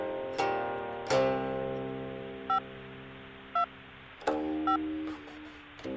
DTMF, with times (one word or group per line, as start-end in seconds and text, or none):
2.5-2.6 5
3.6-3.6 2
4.7-4.8 5